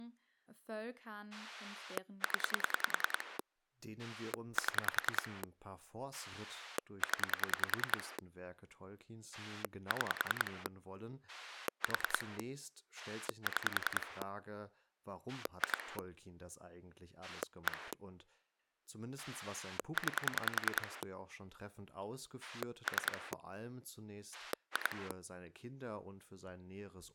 Pulse dialling, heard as a rotary dial, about 10 pulses a second, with speech in German. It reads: 0 7 0 6 4 6 2 1 9 3 2